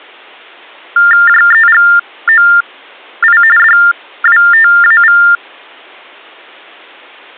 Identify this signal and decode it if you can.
TTY/TDD text telephone tones (45.45 baud Baudot), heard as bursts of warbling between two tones, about 400 Hz shift, 1600 Hz centre. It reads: JEGOI DWTAV